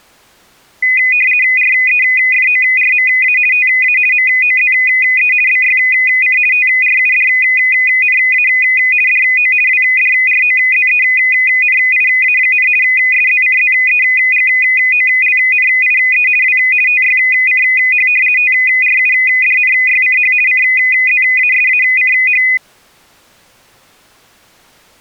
RTTY (50 baud, 450 Hz shift), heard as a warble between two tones, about 2250 Hz centre. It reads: REFORMA TA MOZE BYC TRUDNA DO WDROZENIA, SZCZEGOLNIE W TYCH TRUDNYCH CZASACH